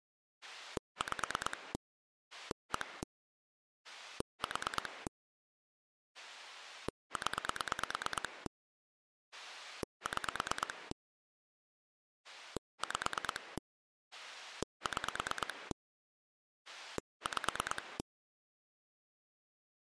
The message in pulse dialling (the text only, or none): 5 1 4 0 6 5 6 5